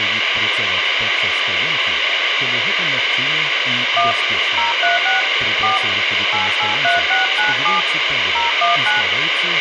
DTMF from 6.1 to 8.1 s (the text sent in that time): 883697